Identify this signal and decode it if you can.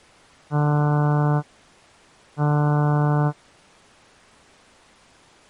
Ship horn signal, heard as a ship's horn, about 150 Hz. 2 short. At sea: I am altering course to port.